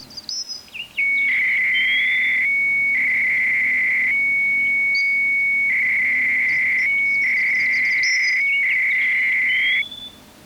300-baud modem data (Bell 103 tones), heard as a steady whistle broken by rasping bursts, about 300 baud, 200 Hz shift.